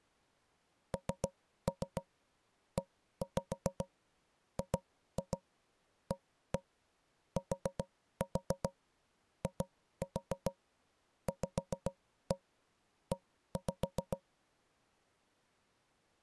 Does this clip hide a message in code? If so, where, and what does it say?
Yes: tap code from 0.9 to 14.2 s, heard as knocks on wood, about 7 knocks a second. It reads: NEGATIVE